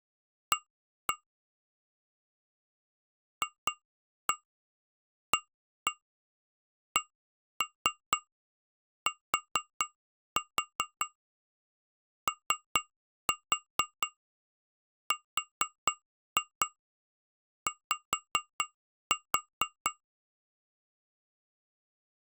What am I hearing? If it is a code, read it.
Tap code, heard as taps on glass, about 4 knocks a second. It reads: A FACTORY